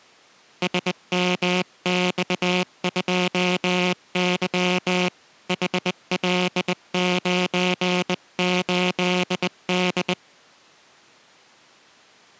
Morse code, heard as a buzzer, hand-sent with a bug key, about 20 wpm. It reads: SMX2Y HL98D